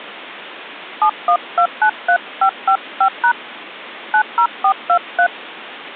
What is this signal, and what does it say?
DTMF, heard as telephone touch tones, dialled by hand, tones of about 80 ms. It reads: 71293555# 90423